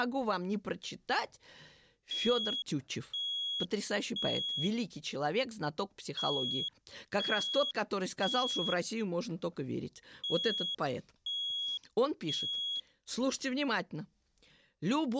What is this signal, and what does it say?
Alarm pattern, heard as an alarm's beeps, played three times, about 3350 Hz, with speech in Russian. Temporal three. Smoke or fire, evacuate.